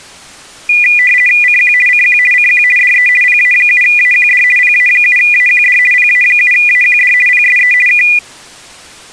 RTTY (50 baud, 450 Hz shift), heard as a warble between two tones, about 2200 Hz centre. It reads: CQ CQ CQ DE PA7AQD PA7AQD PA7AQD PSE K